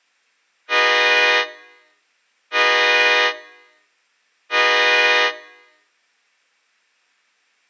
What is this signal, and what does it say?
Train horn signal, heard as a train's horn, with room echo. 3 short. On North American railways: when stopped, the train will back up.